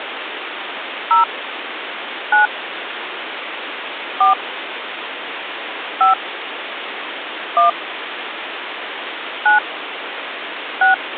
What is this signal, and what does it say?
DTMF, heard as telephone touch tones, dialled by hand, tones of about 130 ms, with phone line noise. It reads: 0 9 4 5 1 9 6